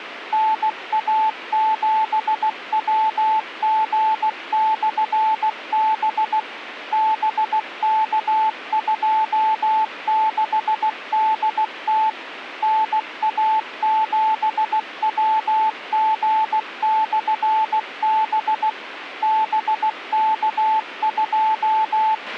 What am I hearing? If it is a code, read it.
Morse code, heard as a keyed tone, machine-sent, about 16 wpm, 870 Hz, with radio hiss and a squelch burst at the end. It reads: NA7WG/B BK26DT NA7WG/B …